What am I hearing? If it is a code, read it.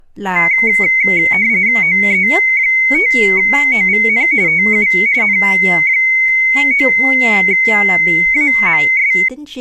RTTY (45.45 baud, 170 Hz shift), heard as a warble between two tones, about 2150 Hz centre, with speech in Vietnamese. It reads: OE5OVN TU N9AMS